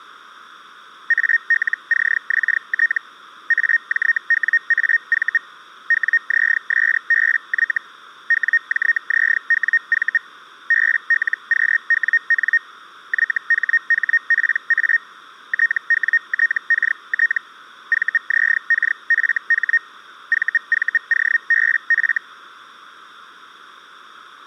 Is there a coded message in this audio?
Yes: Hellschreiber (Feld-Hell, 122.5 baud) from 1.1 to 22.2 s, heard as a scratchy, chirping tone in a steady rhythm, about 1850 Hz. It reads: ALCXT AJWAV WZSBY WJZWV BLQWN YHHPA TWTKT VZKFH VVOBF